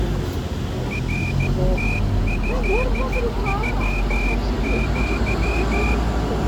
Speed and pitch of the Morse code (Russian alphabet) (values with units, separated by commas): 14 wpm